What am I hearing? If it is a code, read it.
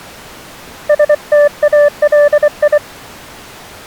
Morse code (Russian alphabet), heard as a keyed tone, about 24 wpm, 580 Hz. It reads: СТАЛИ